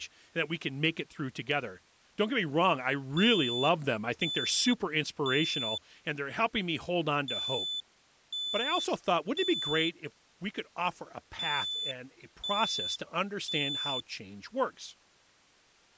Alarm pattern, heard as an alarm's beeps, played three times, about 3500 Hz, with speech in English. Temporal three. Smoke or fire, evacuate.